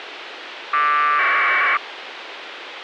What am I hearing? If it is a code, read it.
Packet radio (AX.25, as in APRS), 1200 baud, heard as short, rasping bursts, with radio hiss.